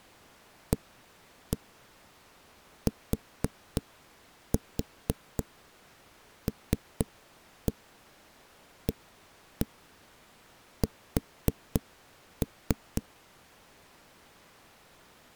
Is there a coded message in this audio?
Yes: tap code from 0.7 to 13.0 s, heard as knocks on a wall, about 3 knocks a second. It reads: ATLAS